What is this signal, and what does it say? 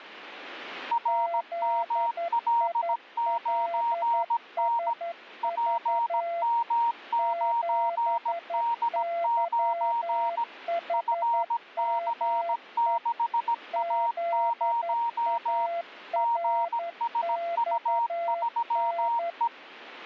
Morse code, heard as two keyed tones. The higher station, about 17 wpm, 940 Hz: RML9N PM9D9 FC6A0 GSU3E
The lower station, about 11 wpm, 680 Hz: ZILSV 7YHME ZARXN